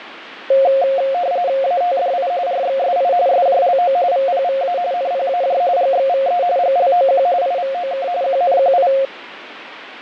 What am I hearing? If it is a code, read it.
RTTY (45.45 baud, 170 Hz shift), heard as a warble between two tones, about 620 Hz centre, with radio static and fading. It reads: ATDI RXSI SJLO VPVA NPAJ GXVE GLOQ IVOK QNQI